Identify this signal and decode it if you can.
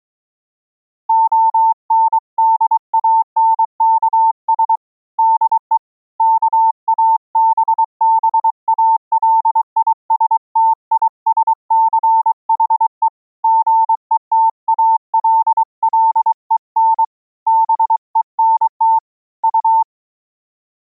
Morse code, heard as a keyed tone, hand-sent with a paddle, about 23 wpm, 900 Hz. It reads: ONDANKS DE KABBALISTISCHE GETALLEN BENT U